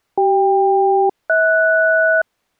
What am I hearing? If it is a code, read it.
Aircraft SELCAL, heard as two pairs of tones. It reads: CK-HS